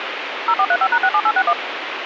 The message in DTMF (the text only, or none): 0435#67861